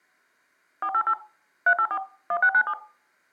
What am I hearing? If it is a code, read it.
DTMF, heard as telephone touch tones, dialled by machine, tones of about 70 ms. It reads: 488 384 1697